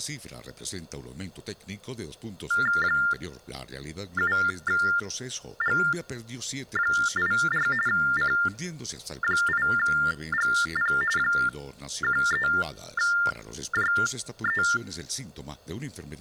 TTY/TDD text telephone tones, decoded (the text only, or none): 7G84 C8GP 13JE